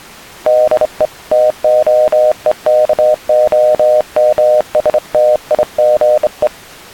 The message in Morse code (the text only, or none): DE TOEKOMSTIGE